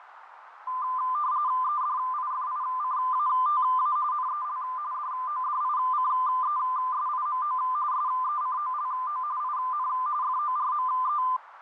RTTY (45.45 baud, 170 Hz shift), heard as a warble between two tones, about 1110 Hz centre, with radio static, fading and a narrow filter. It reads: EDIFICATA NEL DODICESIMO SECOLO IN FORME